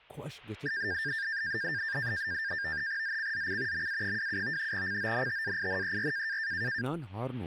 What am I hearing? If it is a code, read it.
NAVTEX (SITOR-B), 100 baud, 170 Hz shift, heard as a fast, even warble, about 1700 Hz centre, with speech in Kashmiri. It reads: ZCZC MA27 CONTAINER